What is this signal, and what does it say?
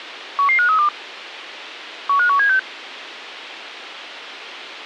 Five-tone selective call (CCIR), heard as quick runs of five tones, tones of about 100 ms, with radio hiss. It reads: 11532 15176